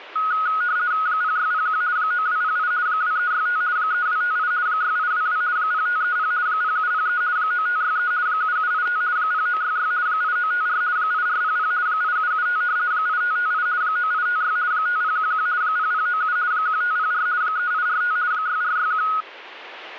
RTTY (50 baud, 170 Hz shift), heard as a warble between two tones, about 1360 Hz centre. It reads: 0601 9208 2365 3258 6822 0530 0703 9563 7785 0966 8954 8400 8775 8558 9856 5011 0097 1504 3845 6461